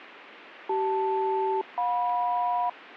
Aircraft SELCAL, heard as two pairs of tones. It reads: CL-JM